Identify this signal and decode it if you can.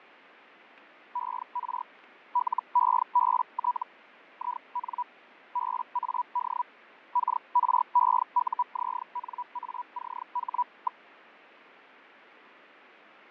Hellschreiber (Feld-Hell, 122.5 baud), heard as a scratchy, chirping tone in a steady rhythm, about 980 Hz, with radio static and fading. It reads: ER LEBT IN BAD KREUZNACH.